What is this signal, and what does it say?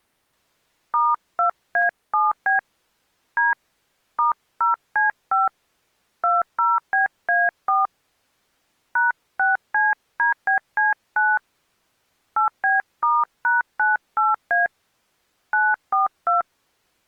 DTMF, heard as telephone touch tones, dialled by hand, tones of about 160 ms. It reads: *2A7B D *0C5 20BA4 #6CDBC9 8B*#98A 942